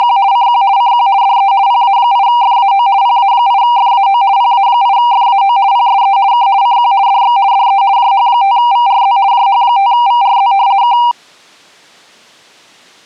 RTTY (50 baud, 170 Hz shift), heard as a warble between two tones, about 870 Hz centre. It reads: … CQ CQ DE PA8FAO PA8FAO PA8FAO PSE K CQ DX DE JH5VRZ JH5VRZ K